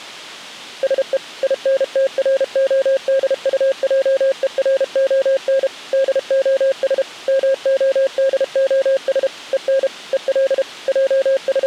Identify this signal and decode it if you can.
Morse code, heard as a keyed tone, machine-sent, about 32 wpm, 540 Hz. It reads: SE INTRODUJERON DOS MODOS EN EL …